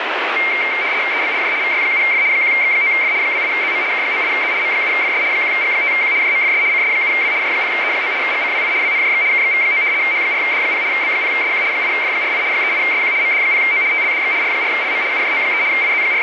RTTY (75 baud, 170 Hz shift), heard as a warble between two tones, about 2200 Hz centre, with radio static. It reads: EBLJ VY7F 1X9F 28ZM K98Z M7FS 1G5Q JMFS CS7W J0E9 GCWI WNJX KXV9 H4D0 B0SQ 8F48 38SQ MD0O TLDX R4LM UJO3 …